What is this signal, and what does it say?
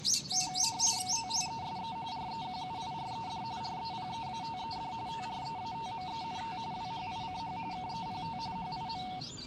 RTTY (45.45 baud, 170 Hz shift), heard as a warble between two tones, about 820 Hz centre, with the noise of a park. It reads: THESE REQUIRED REPEATED TREATMENT WHICH KEPT HIM